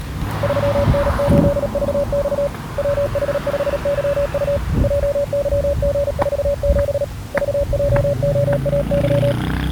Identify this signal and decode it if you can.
Morse code, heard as a keyed tone, hand-sent with a paddle, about 37 wpm, 570 Hz, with the noise of a residential street. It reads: 3N8VX WH5YU JYG47 VJOAY